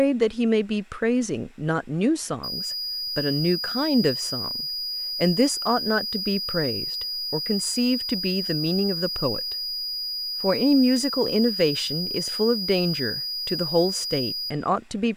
A steady tone, with room echo and speech in English. There is no code.